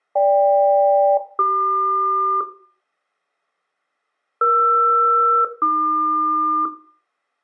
Aircraft SELCAL, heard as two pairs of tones, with room echo. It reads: GK-CQ ER-AQ